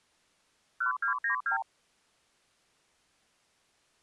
Multi-frequency trunk signalling (R2, with the far end's replies), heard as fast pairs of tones, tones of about 110 ms. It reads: 1292